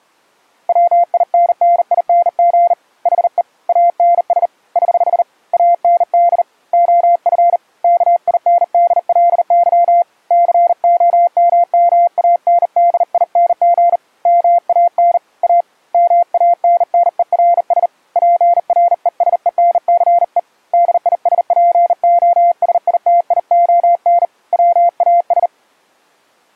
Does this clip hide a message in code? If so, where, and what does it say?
Yes: Morse code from 0.6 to 25.5 s, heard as a keyed tone, hand-sent with a bug key, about 39 wpm, 690 Hz. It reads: WINNING HE ANS <HH> AND OF KINDLY COMMANDING MAN A MANNERS PRESENCE DISPOSITION WAS